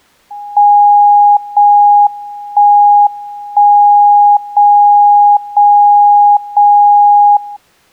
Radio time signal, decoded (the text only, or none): 0 1 1 0 0 0 0